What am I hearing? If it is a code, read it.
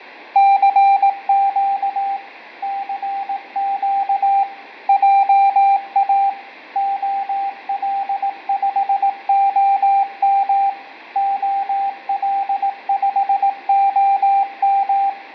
Morse code, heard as a keyed tone, machine-sent, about 18 wpm, 790 Hz, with radio static and fading. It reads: CQ CQ JA OL5OM OL5OM